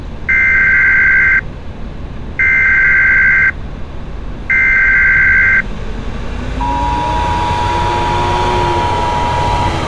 Emergency Alert System (SAME) tones (header bursts, then the 853 and 960 Hz attention tone), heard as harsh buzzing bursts, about 520.83 baud, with street noise.